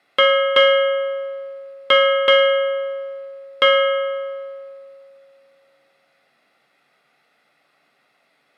Ship's bell, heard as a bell, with room echo. 5. Five half-hours of the watch have passed.